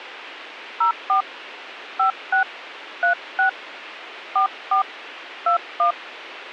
DTMF, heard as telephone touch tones, dialled by hand, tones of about 110 ms, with radio hiss. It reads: 04 56 36 44 21